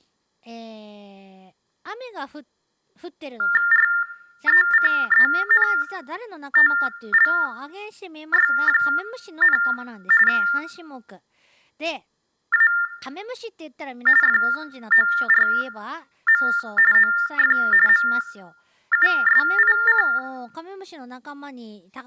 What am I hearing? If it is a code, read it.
TTY/TDD text telephone tones (45.45 baud Baudot), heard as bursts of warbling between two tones, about 400 Hz shift, 1600 Hz centre, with room echo and speech in Japanese. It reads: RECENTLY, A FORM OF MUSIC